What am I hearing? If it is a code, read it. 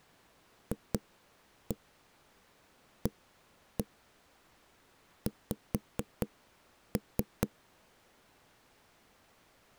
Tap code, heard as knocks on wood, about 4 knocks a second. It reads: FAX